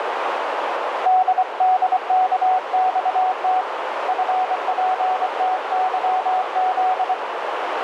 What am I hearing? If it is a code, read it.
Morse code, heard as a keyed tone, hand-sent with a paddle, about 24 wpm, 740 Hz, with radio static and a narrow filter. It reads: DDKXT FPTYZ